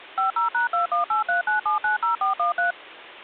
DTMF, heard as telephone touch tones, dialled by machine, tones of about 130 ms. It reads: 50#21839790413